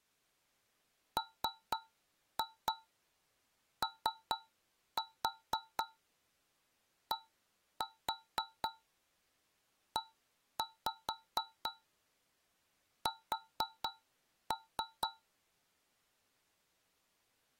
Tap code, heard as taps on a metal pipe, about 4 knocks a second. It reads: MODES